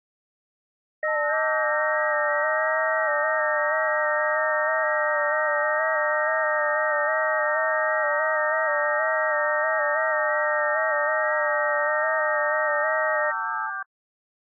FT8 (several signals at once), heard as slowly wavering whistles, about 6.25 baud.